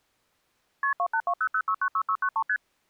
Multi-frequency trunk signalling (R1, as on North American trunks), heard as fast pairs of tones, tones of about 70 ms. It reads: KP 28200696693 ST